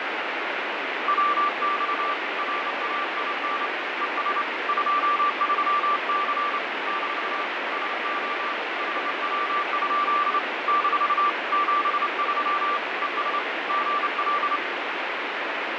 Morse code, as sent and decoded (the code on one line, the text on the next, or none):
.-- -..- / .-. .- .. -. / . ... / ..--- ...-- -.-. / -....- / ... --- / .... .-- ..--.. / -....- / --... ...-- / . ... / --. .-..
WX RAIN ES 23C - SO HW? - 73 ES GL